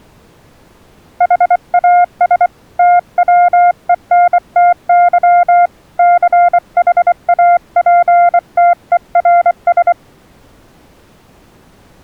Morse code, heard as a keyed tone, hand-sent with a bug key, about 24 wpm, 700 Hz. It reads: HAS TWENTY CHAPTERS